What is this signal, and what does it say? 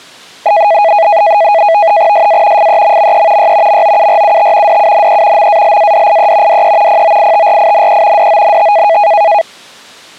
NAVTEX (SITOR-B), 100 baud, 170 Hz shift, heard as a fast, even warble, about 740 Hz centre. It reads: SA FEMME Y MOURUT DUNE MALADIE DE POITRINE DONT